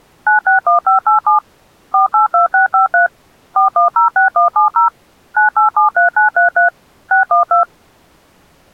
DTMF, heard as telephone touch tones, dialled by machine, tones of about 120 ms. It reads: 961587 482653 4106170 9873933 612